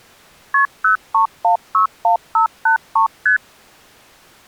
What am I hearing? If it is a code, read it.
Multi-frequency trunk signalling (R1, as on North American trunks), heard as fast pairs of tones, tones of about 110 ms. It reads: KP 03161583 ST